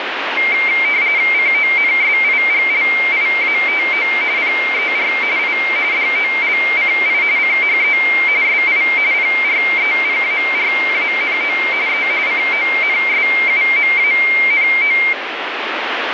RTTY (45.45 baud, 170 Hz shift), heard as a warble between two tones, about 2200 Hz centre, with radio static. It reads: CONSIGLIATO PER I DOLCI CHE SI PREPARANO E CONSUMANO